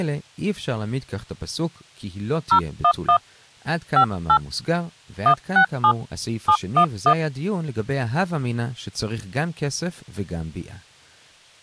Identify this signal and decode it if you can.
DTMF, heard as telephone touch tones, dialled by hand, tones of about 80 ms, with speech in Hebrew. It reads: 011 58 167 711